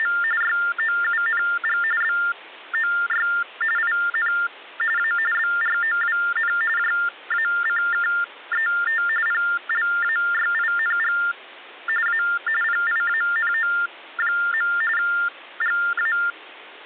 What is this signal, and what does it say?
TTY/TDD text telephone tones (45.45 baud Baudot), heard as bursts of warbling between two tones, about 400 Hz shift, 1600 Hz centre. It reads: … YOUNG BOY IN A BROWN JACKET PLAYING A PIANO. GA